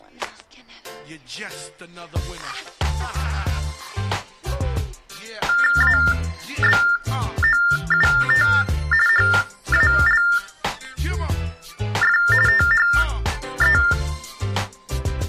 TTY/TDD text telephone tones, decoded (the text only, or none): ABOUT HALF THE